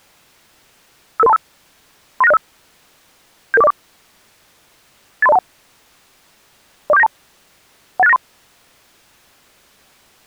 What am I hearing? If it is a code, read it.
Five-tone selective call (EIA), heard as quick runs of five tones, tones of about 30 ms. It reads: 55325 39605 77404 83021 04792 18693